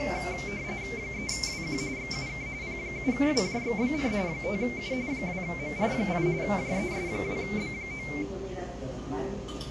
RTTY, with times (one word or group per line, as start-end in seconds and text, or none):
1.0-1.8 3WQ
2.0-2.5 XUK
2.6-4.1 P7WJXBN
4.3-4.9 5U
5.1-6.3 2MR8
6.4-8.1 JES2B9